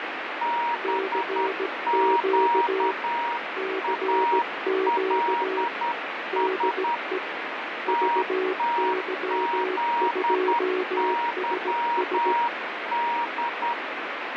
Morse code, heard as two keyed tones, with heavy radio static. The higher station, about 10 wpm, 950 Hz: BQALS TTZYD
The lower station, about 17 wpm, 380 Hz: CQ CQ DE VY2SS